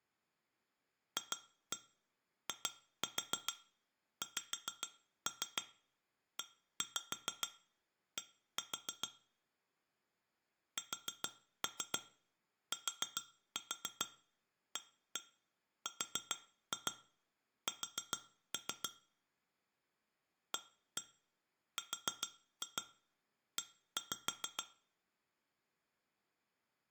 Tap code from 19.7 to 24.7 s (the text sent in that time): ARE